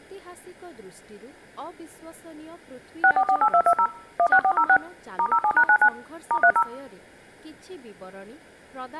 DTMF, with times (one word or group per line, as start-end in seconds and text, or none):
3.0-3.9 6448220
4.2-4.8 16406
5.2-5.9 *07#99
6.3-6.6 *30